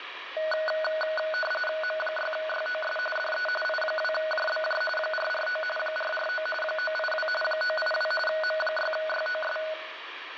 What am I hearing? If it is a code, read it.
RTTY (45.45 baud, 850 Hz shift), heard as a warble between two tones, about 1050 Hz centre, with radio static. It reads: M6YOS DE I2JBJ 449 449 982 982 M6YOS